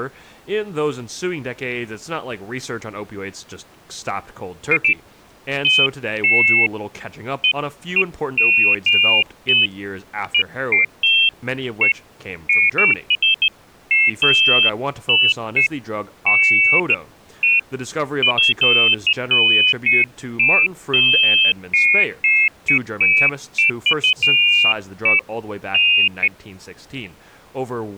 Pairs of high tones at irregular times, with speech in English. There is no code.